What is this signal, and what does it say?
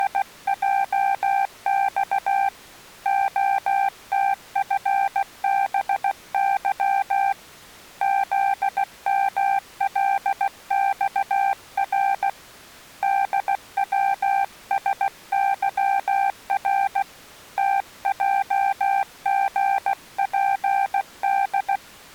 Morse code, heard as a keyed tone, hand-sent with a paddle, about 16 wpm, 790 Hz. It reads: … OTFBY ZMLXR DWSYR TJGPD